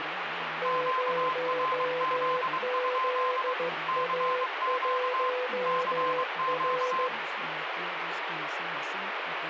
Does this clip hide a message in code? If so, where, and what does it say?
Yes: Morse code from 0.6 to 7.1 s, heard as two keyed tones, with radio static and speech in Spanish. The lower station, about 15 wpm, 500 Hz: 0ZA1R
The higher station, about 23 wpm, 1040 Hz: QRZ? CQ CQ